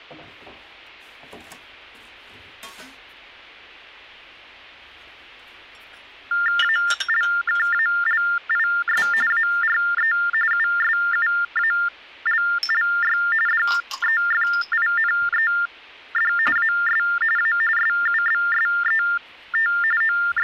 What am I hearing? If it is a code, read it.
TTY/TDD text telephone tones (45.45 baud Baudot), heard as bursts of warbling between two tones, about 400 Hz shift, 1600 Hz centre. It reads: ALKALIS ARE USUALLY DEFINED AS A SUBSET …